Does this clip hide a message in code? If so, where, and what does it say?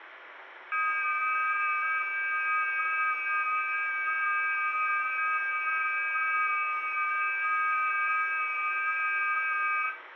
Yes: FT8 (several signals at once) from 0.7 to 9.9 s, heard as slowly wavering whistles, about 6.25 baud, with radio static and room echo.